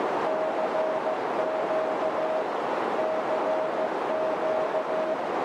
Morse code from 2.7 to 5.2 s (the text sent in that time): CQ